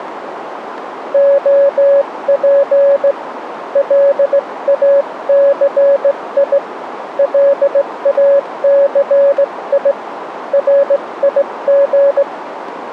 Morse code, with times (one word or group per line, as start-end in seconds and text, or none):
1.1-3.1 OP
3.8-6.6 LACI
7.2-9.9 LACI
10.5-12.2 RIG